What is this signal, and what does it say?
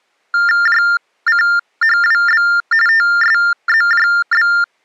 TTY/TDD text telephone tones (45.45 baud Baudot), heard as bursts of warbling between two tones, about 400 Hz shift, 1600 Hz centre. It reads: JCHWB TSZJB